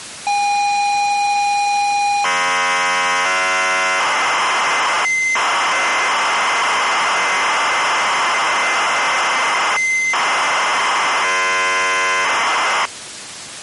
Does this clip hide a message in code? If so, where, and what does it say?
Yes: ZX Spectrum tape loading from 0.3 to 12.9 s, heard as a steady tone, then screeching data.